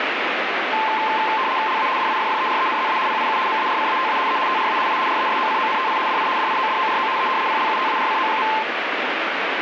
RTTY (75 baud, 170 Hz shift), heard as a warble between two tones, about 960 Hz centre, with radio static. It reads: LA DIFFERENZA PIU MARCATA E TRA I RESOCONTI DI DIODORO E PLUTARCO.